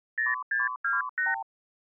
Multi-frequency trunk signalling (R2, with the far end's replies), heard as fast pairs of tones, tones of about 170 ms. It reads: 0628